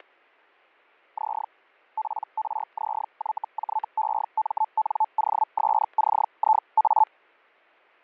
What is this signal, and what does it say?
Hellschreiber (Feld-Hell, 122.5 baud), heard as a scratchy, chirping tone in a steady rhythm, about 870 Hz, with fading and static crashes. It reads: Z PRZYJEMNOSCIA